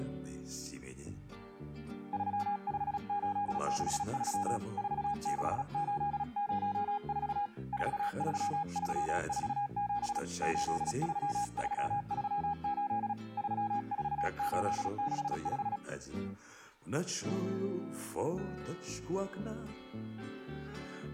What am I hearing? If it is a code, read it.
Morse code, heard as a keyed tone, hand-sent with a paddle, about 36 wpm, 820 Hz. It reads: 35863 46804 43347 83338 34865